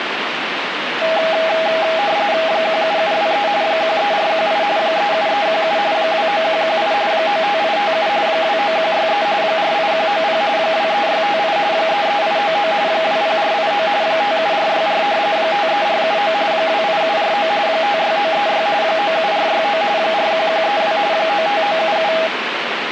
RTTY (45.45 baud, 170 Hz shift), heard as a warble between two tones, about 730 Hz centre, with radio static. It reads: 17723 13418 37317 29118 95857 29163 48190 23658 33899 20489 57464 53479 28749 56936 97469 41132 95977